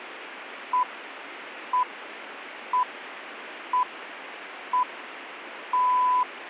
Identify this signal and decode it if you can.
Radio time signal (six pips, as the Greenwich Time Signal), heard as pips.